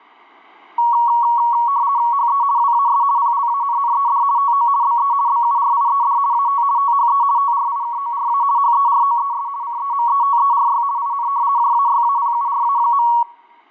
RTTY (50 baud, 170 Hz shift), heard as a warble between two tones, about 1030 Hz centre. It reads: HE WAS PLANNED TO BE BURIED AT THE TRIKORA HEROES CEMETERY IN JAYAPURA.